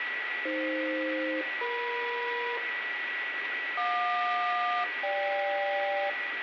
Aircraft SELCAL, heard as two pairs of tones, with radio static, a steady whistle near 1940 Hz and room echo. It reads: AF-EM JQ-GK